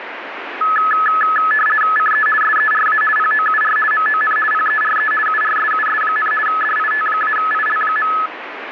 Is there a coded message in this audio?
Yes: RTTY (50 baud, 450 Hz shift) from 0.6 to 8.3 s, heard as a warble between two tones, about 1500 Hz centre, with radio static. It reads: CE SERA POUR MON PERE URSUS, DIT-IL.